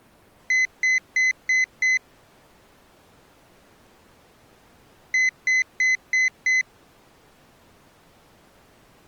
Beep code, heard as a piezo beeper, played twice, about 2050 Hz. 5 short. In AMI BIOS tables: processor failure; in Dell tables: CMOS battery failure.